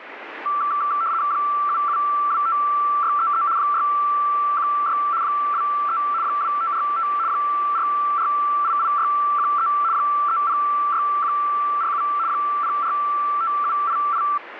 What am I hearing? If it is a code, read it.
RTTY (75 baud, 170 Hz shift), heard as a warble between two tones, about 1250 Hz centre, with radio static. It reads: 7725633 616 23 2545 4488613 306147 045788